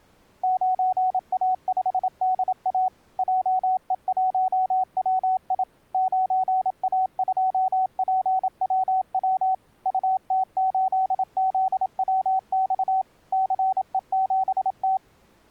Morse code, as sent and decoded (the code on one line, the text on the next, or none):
----. .- ..... -.. .- / .--- . .---- .-- .. / ----. .- ..--- .--. .-- .-- / ..- - ---.. --.. .-- -..- / -.-. . --... -
9A5DA JE1WI 9A2PWW UT8ZWX CE7T